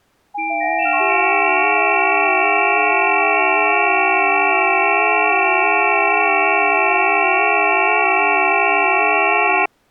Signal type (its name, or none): FT8